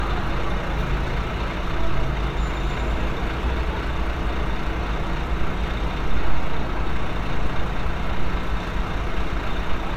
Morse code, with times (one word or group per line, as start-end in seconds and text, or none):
none